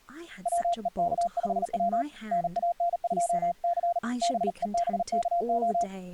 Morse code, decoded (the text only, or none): WEK5W NAN2C BEBKO